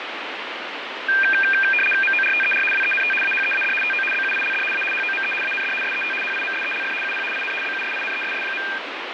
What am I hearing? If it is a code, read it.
RTTY (75 baud, 850 Hz shift), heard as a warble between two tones, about 2000 Hz centre, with radio static and fading. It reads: MORTER WENT AHEAD TO BUILD A HOME AND SET HIMSELF UP IN BUSINESS.